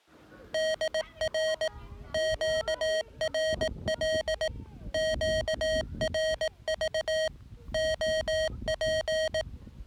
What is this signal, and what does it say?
Morse code, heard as electronic beeps, machine-sent, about 18 wpm, 630 Hz, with the noise of a residential street. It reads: DR QRL QRV OP